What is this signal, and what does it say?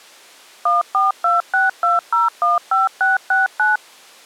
DTMF, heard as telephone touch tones, dialled by machine, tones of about 160 ms. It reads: 14262015669